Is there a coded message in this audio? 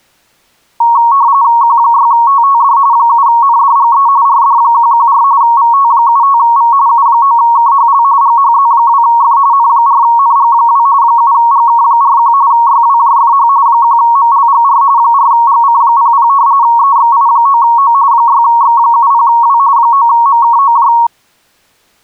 Yes: RTTY (45.45 baud, 170 Hz shift) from 0.8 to 21.1 s, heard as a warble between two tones, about 1020 Hz centre. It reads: Q6TTD 7NDGE RD114 VT75V U9KHL GHZ2F N4NG2 7GK41 YWJFH 1MLGR 4GC00 EXI9O 6X70W 9MKOJ